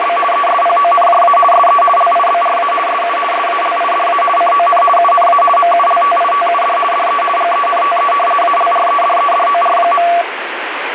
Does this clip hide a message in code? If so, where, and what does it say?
Yes: RTTY (50 baud, 450 Hz shift) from 0.0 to 10.2 s, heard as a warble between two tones, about 920 Hz centre, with radio static. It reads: … ESPONJA SE LIBRA SU SALIDA CON UNA MULTITUD DE GENTE ALREDEDOR.